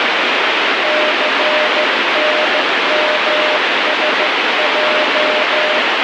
Morse code, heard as a keyed tone, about 14 wpm, 610 Hz, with heavy radio static. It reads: CNMSJ